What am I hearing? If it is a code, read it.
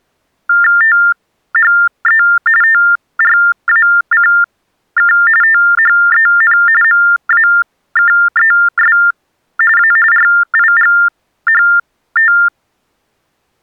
TTY/TDD text telephone tones (45.45 baud Baudot), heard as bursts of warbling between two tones, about 400 Hz shift, 1600 Hz centre. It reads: THE TRACK THEN MAKES A RIGHT